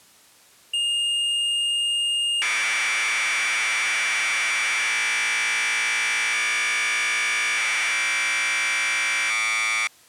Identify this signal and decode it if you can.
Commodore tape loading (standard loader), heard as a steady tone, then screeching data.